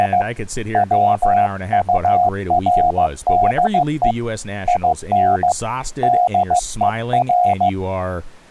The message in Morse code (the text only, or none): … WURDE IN DER